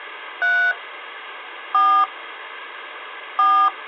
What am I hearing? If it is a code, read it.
DTMF, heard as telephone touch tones, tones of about 300 ms, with phone line noise. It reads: 3 4 4